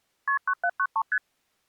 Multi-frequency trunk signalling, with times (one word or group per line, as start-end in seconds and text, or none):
0.3-0.4 KP
0.5-1.0 9793
1.1-1.2 ST